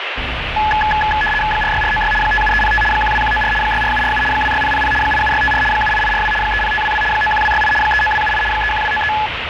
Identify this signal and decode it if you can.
RTTY (75 baud, 850 Hz shift), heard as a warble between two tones, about 1280 Hz centre, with radio static and street noise. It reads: 46496 57305 12194 64747 26000 87654 78842 30522 91268 39278 31293